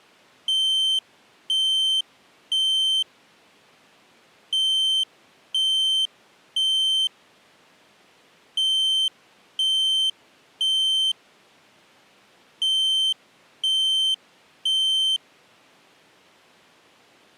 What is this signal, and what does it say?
Alarm pattern, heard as an alarm's beeps, played four times, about 3100 Hz. Temporal three. Smoke or fire, evacuate.